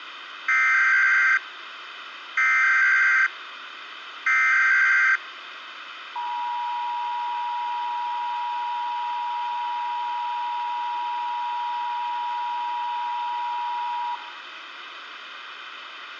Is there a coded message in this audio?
Yes: Emergency Alert System (SAME) tones (header bursts, then the 853 and 960 Hz attention tone) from 0.5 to 14.2 s, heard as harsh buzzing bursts, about 520.83 baud, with radio hiss.